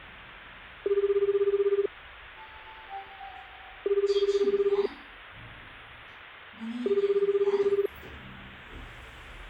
Telephone call progress tone (Japanese plan), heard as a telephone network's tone, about 380, 400, 420 Hz, 1 s on and 2 s off, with hum and the noise inside a lift. Ringback tone.